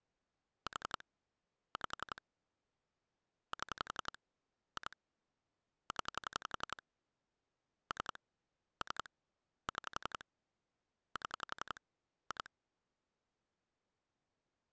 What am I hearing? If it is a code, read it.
Pulse dialling, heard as clicks on a phone line, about 11 pulses a second. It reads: 4 5 7 2 0 3 3 6 7 2